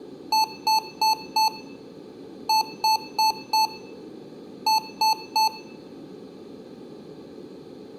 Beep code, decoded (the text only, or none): 4-4-3